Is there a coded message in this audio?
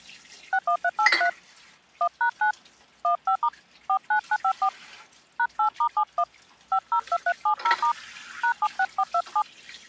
Yes: DTMF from 0.5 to 9.4 s, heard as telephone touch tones, dialled by hand, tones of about 80 ms, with hum and kitchen noise. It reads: 61383 1#9 15* 49954 #8*71 502370* #76427